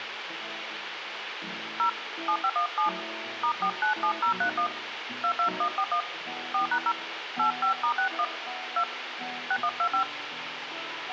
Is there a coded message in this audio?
Yes: DTMF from 1.8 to 10.0 s, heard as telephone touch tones, dialled by hand, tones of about 90 ms, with phone line noise. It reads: 0 7517 *497031 22141 4#0 85*61 2 6125